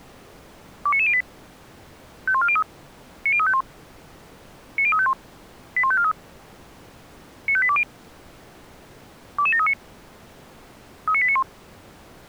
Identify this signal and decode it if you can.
Five-tone selective call (ZVEI), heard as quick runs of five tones, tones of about 70 ms. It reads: 29908 51403 90351 90351 81543 95820 22739 39891